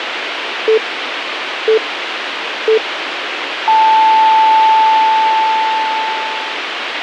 Radio time signal (three low pips and a long one an octave up, as on NHK), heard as pips, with radio hiss.